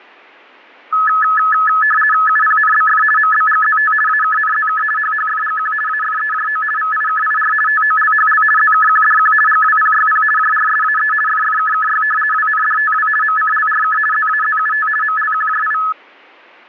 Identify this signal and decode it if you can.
RTTY (50 baud, 450 Hz shift), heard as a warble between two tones, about 1500 Hz centre. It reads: UPNBF MBGZT AKNZK HHFGQ AFEJO VIKIR TOLHL ZKQDQ GWPYP JRSAE FFKKY WNDTW MCLRK ZAZUT MLQJI